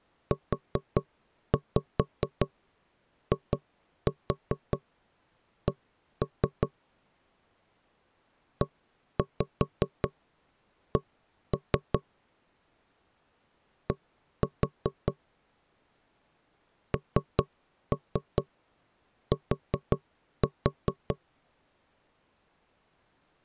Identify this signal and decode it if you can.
Tap code, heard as knocks on wood, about 5 knocks a second. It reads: UIC EC D NT